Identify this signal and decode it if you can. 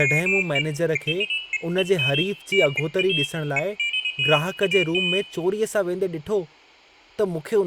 Pairs of high tones at irregular times, with room echo and speech in Sindhi. There is no code.